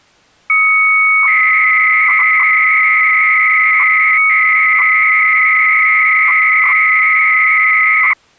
300-baud modem data (Bell 103 tones), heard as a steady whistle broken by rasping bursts, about 300 baud, 200 Hz shift.